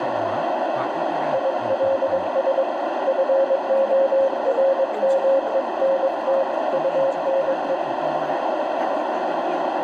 Morse code, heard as a keyed tone, hand-sent with a paddle, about 22 wpm, 540 Hz, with heavy radio static, a narrow filter and speech in Vietnamese. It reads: ILS FORMENT UNE